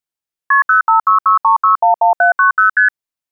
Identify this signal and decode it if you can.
Multi-frequency trunk signalling (R1, as on North American trunks), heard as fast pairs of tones, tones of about 120 ms. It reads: KP 05663611790 ST